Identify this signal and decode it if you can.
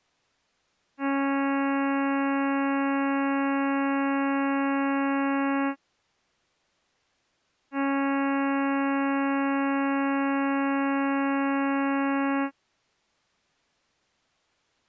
Ship horn signal, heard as a ship's horn, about 280 Hz. 2 long. At sea: a vessel under power that has stopped in fog.